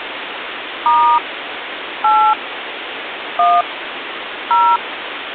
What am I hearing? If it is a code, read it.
DTMF, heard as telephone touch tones, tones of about 270 ms, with phone line noise. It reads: * 8 1 0